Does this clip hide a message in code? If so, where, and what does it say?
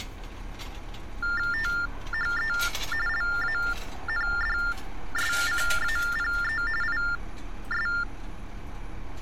Yes: TTY/TDD text telephone tones (45.45 baud Baudot) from 1.2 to 8.0 s, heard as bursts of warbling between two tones, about 400 Hz shift, 1600 Hz centre, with street noise. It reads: THE LANDSCAPE IS